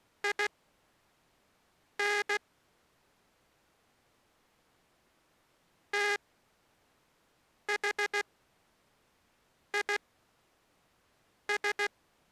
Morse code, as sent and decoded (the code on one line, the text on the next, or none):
.. -. / - .... .. ...
IN THIS